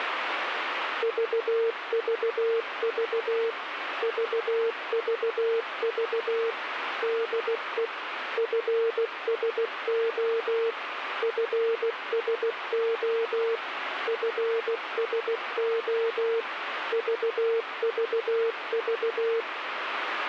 Morse code, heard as a keyed tone, machine-sent, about 16 wpm, 460 Hz, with radio static. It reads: VVV VVV DE FSO FSO FSO VVV